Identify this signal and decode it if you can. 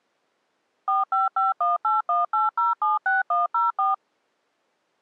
DTMF, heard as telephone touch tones, dialled by machine, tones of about 160 ms. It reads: 4551818076104